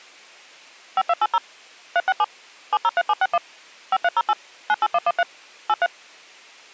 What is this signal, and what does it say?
DTMF, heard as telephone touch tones, dialled by machine, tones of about 40 ms. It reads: 5280 367 703761 5308 98113 83